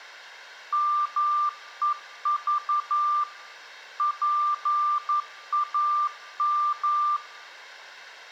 Morse code (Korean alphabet), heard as a keyed tone, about 11 wpm, 1190 Hz, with room echo. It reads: 말 좀